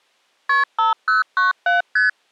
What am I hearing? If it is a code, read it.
Multi-frequency trunk signalling (R1, as on North American trunks), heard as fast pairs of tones, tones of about 150 ms. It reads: KP 5097 ST